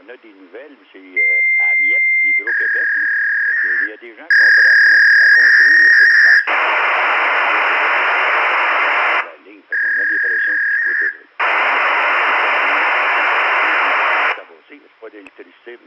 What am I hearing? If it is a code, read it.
Fax machine handshake, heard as a long tone, a warble and hiss, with room echo.